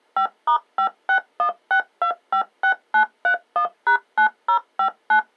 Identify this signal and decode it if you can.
DTMF, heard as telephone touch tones, dialled by machine, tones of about 90 ms. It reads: 5*5616256931#9059